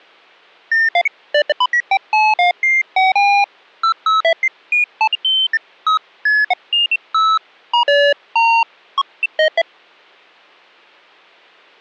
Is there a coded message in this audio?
No, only electronic bleeps of random pitch and length.